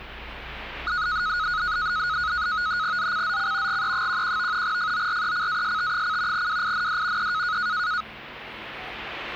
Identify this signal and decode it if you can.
NAVTEX (SITOR-B), 100 baud, 170 Hz shift, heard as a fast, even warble, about 1360 Hz centre, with the noise inside a lift. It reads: ZCZC GE11 FORECAST: WIND E